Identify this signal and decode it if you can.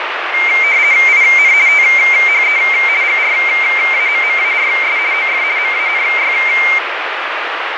RTTY (50 baud, 170 Hz shift), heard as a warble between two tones, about 2200 Hz centre, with radio static. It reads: IN THE GRAMMARS OF MANY